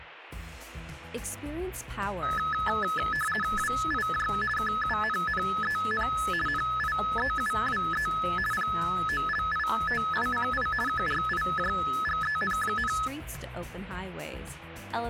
RTTY (50 baud, 450 Hz shift), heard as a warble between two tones, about 1500 Hz centre. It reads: WIJ KUNNEN NIEUWE POLITICI KRIJGEN,